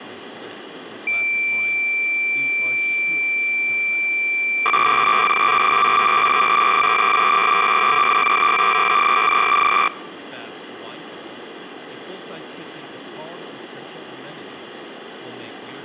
Cassette data (Kansas City type), 300 baud, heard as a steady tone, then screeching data, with speech in English.